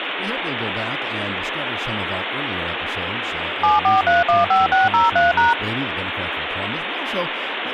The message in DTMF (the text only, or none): 74315603#